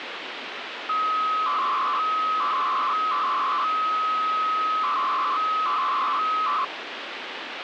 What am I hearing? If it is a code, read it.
300-baud modem data (Bell 103 tones), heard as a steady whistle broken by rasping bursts, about 300 baud, 200 Hz shift, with phone line noise.